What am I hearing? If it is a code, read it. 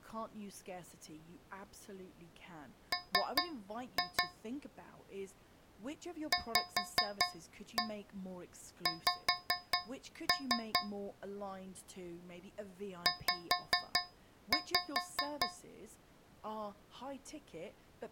Tap code, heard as taps on a metal pipe, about 4 knocks a second, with speech in English. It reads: M VX Z